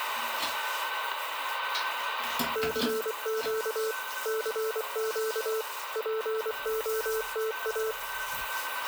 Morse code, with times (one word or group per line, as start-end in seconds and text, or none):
2.6-3.9 CQ
4.3-5.6 CQ
6.0-7.9 POTA